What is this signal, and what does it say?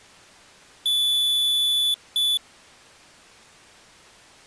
Beep code, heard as a piezo beeper, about 3450 Hz. 1 long, 1 short. In IBM BIOS tables: system board problem.